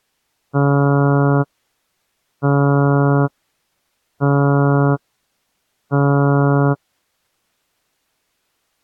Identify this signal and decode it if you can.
Ship horn signal, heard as a ship's horn, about 140 Hz. 4 short. At sea: a pilot vessel's identity signal in fog.